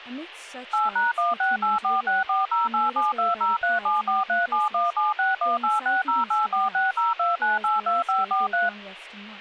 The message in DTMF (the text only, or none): 8#1684640872037437176186084602982543